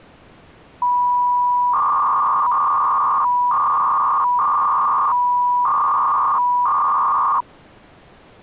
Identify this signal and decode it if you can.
300-baud modem data (V.21 tones), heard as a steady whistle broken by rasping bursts, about 300 baud, 200 Hz shift.